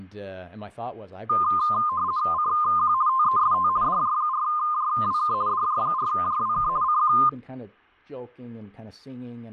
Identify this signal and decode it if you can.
RTTY (50 baud, 170 Hz shift), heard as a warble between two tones, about 1130 Hz centre, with speech in English. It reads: CQ TEST DJ4JWK DJ4JWK CQ